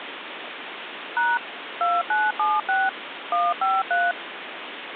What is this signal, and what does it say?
DTMF, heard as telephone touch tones, dialled by machine, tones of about 210 ms, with phone line noise. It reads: # 2976 153